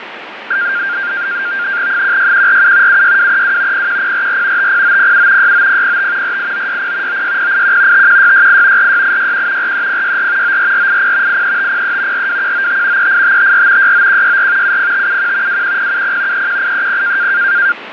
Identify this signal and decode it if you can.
NAVTEX (SITOR-B), 100 baud, 170 Hz shift, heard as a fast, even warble, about 1500 Hz centre, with radio static and fading. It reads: 16147 76232 01044 50907 69005 48960 96081 51668 46861 43064 94480 83503 42195 38554 69164 70571 21070 31830